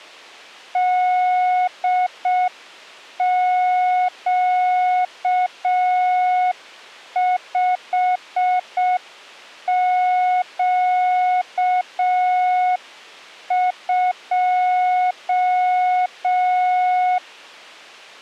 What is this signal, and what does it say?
Morse code, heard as a keyed tone, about 6 wpm, 730 Hz. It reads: DQ5Q2